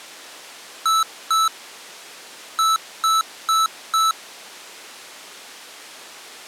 Beep code, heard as beeps from a small speaker, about 1310 Hz. 2-4.